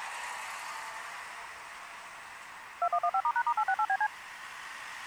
DTMF, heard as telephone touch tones, dialled by machine, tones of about 60 ms, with street noise. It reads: 2115*#*868BC